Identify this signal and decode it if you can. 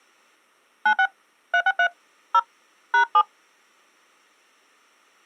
DTMF, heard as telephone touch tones, dialled by hand, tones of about 80 ms. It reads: 96 363 0 #7